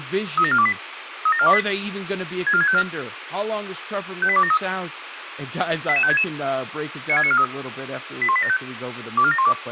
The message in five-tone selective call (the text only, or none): 37428 37428 64654 58273 88566 96943 81875 24712